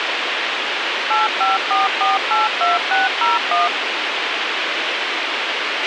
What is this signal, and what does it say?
DTMF, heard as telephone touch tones, dialled by machine, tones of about 160 ms, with radio hiss and a squelch burst at the end. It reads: 854482601